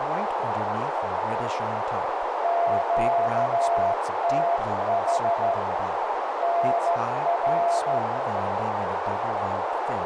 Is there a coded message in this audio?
Yes: Morse code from 2.4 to 8.0 s, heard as a keyed tone, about 13 wpm, 690 Hz, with heavy radio static, a narrow filter and speech in English. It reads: QTH NR